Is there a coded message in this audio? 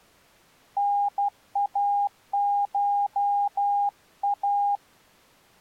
Yes: Morse code (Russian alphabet) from 0.7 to 4.8 s, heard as a keyed tone, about 12 wpm, 810 Hz. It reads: НАША